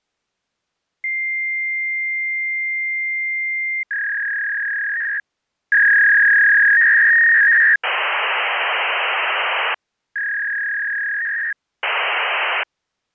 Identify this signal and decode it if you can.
Fax machine handshake, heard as a long tone, a warble and hiss.